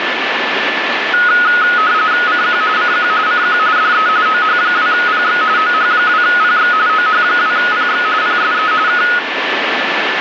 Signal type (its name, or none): RTTY